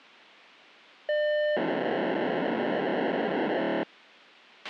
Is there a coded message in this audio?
Yes: POCSAG pager data (1200 baud) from 1.1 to 3.8 s, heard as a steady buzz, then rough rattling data, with a squelch burst at the end.